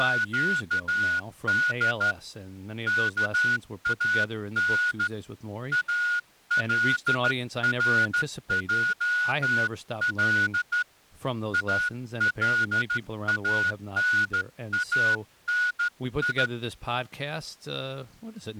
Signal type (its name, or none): Morse code